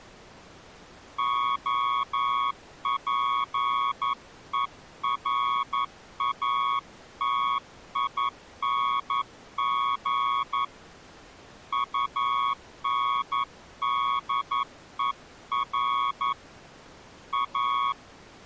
Morse code, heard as a keyed tone, hand-sent with a paddle, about 11 wpm, 1110 Hz. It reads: OPERATING UNDER A